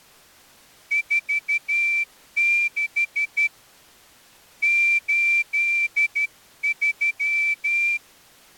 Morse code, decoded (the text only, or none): 46 83